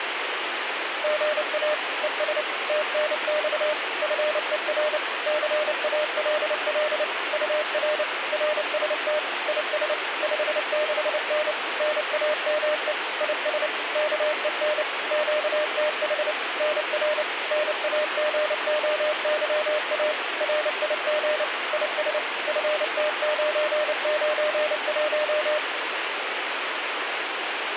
Morse code, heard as a keyed tone, machine-sent, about 29 wpm, 610 Hz, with radio static. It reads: GA ES TNX FER CALL UR RST IS 56N NAME IS KEN QTH NR NAGOYA RIG IS FT991